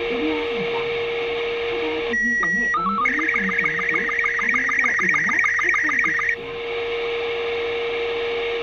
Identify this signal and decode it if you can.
SSTV (slow-scan television), Robot 36, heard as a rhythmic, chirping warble, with radio static, a steady whistle near 470 Hz and the noise inside a bus.